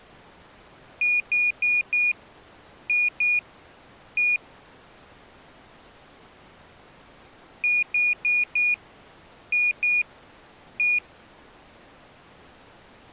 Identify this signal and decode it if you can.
Beep code, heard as a piezo beeper, played twice, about 2450 Hz. 4-2-1. In Phoenix BIOS tables: timer tick failure.